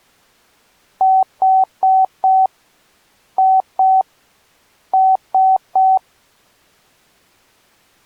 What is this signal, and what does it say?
Beep code, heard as beeps, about 760 Hz. 4-2-3. In Phoenix BIOS tables: gate A20 failure.